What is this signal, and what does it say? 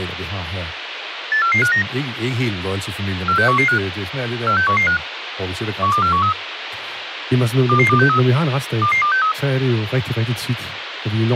Five-tone selective call (CCIR), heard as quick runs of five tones, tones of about 100 ms, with radio hiss and speech in Danish. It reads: 84459 46115 46115 12413 22263 22263